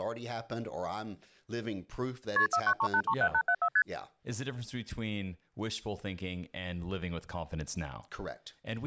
Multi-frequency trunk signalling (R1, as on North American trunks), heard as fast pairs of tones, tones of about 70 ms, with speech in English. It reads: KP 493837874 ST